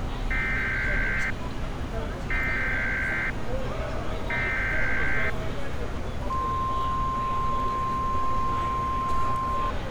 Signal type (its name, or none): Emergency Alert System (SAME) tones